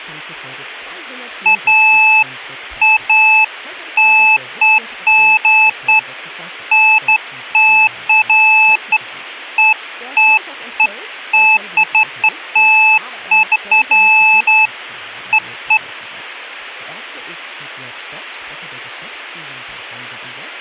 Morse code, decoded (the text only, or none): none